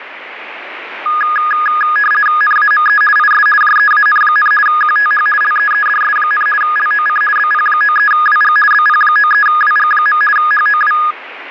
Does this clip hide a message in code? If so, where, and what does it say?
Yes: RTTY (50 baud, 450 Hz shift) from 1.1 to 11.1 s, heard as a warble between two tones, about 1450 Hz centre, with radio static. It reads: NAME IS JEAN, QTH LEEDS, LOC BP93WG BP93WG. HOW